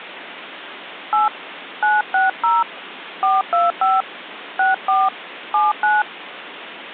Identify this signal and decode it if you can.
DTMF, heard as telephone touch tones, dialled by hand, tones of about 180 ms, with phone line noise. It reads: 8 960 425 64 79